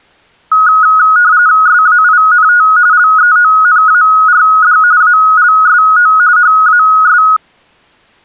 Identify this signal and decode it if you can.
RTTY (45.45 baud, 170 Hz shift), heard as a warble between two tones, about 1360 Hz centre. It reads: SAINT LEONARD ALSO HAS